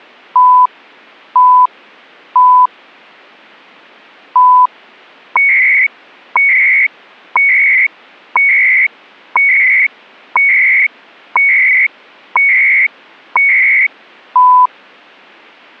Radio time signal (CHU, Canada), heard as beeps and data bursts, one a second.